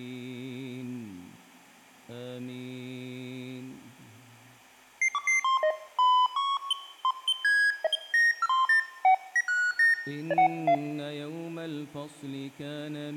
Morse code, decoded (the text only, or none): none